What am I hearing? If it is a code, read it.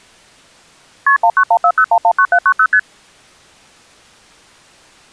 Multi-frequency trunk signalling (R1, as on North American trunks), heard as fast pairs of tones, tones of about 70 ms. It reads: KP 19140119790 ST